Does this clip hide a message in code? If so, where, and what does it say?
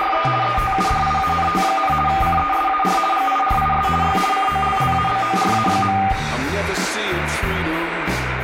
Yes: RTTY (50 baud, 450 Hz shift) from 0.0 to 6.1 s, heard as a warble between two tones, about 1000 Hz centre, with radio static and room echo. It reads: … ETUDIANT, CESAR GIRIS Y COLLABORA.